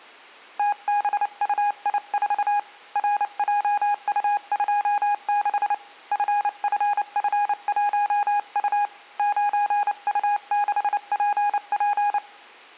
Morse code, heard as a keyed tone, hand-sent with a paddle, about 29 wpm, 820 Hz. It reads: TBUI4 RJU26 FFF1U 9U6PP